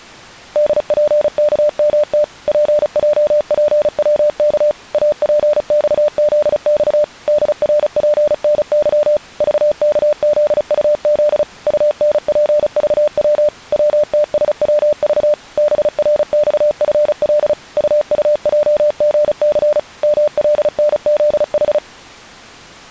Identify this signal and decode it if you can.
Morse code, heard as a keyed tone, machine-sent, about 35 wpm, 600 Hz. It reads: DPKMT PJPWK APXZX DRPNY VKZUZ UNPVW WTSWV BRXFL UUJGC MLNZH